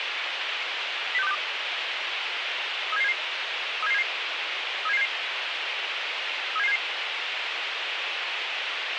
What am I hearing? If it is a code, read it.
Five-tone selective call (EEA), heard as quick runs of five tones, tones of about 40 ms, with radio hiss. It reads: 06262 37777 37777 37777 37777